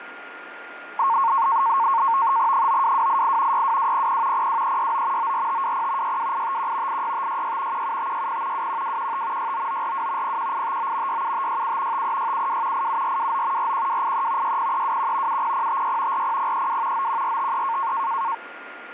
NAVTEX (SITOR-B), 100 baud, 170 Hz shift, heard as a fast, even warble, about 1000 Hz centre, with radio static and a steady whistle near 1420 Hz. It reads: 92288 62200 02369 94520 62851 86566 17560 21215 69942 01859 67567 53672 87429 41283 60321 70056 40032 91453